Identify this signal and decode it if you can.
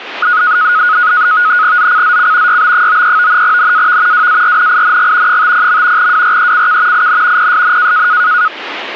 NAVTEX (SITOR-B), 100 baud, 170 Hz shift, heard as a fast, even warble, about 1360 Hz centre, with radio static. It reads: ZCZC YB93 NAV WARNING 50. WRECK IN PSN